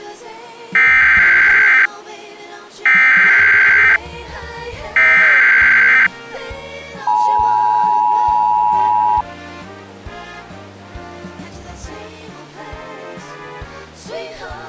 Emergency Alert System (SAME) tones (header bursts, then the 853 and 960 Hz attention tone), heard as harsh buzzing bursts, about 520.83 baud.